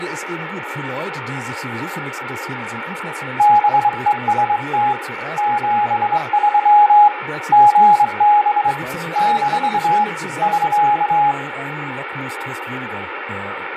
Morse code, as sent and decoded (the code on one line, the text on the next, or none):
-... . ... - / --... ...-- / --. -... / -....- / ...-.-
BEST 73 GB - <SK>